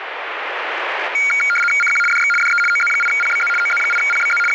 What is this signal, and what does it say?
RTTY (75 baud, 850 Hz shift), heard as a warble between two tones, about 1850 Hz centre, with radio static. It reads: CQ DX DE OZ8PBZ OZ8PBZ …